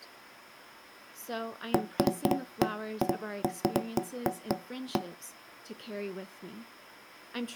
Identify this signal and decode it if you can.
Irregular knocks on wood, with speech in English. There is no code.